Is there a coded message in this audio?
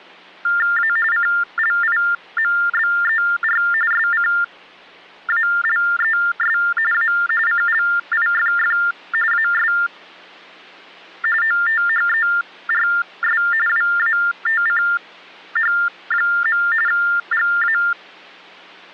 Yes: TTY/TDD text telephone tones (45.45 baud Baudot) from 0.4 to 17.9 s, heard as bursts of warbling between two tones, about 400 Hz shift, 1600 Hz centre. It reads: A CLIMBER SCALES A CLIFF AS OTHERS WATCH. GA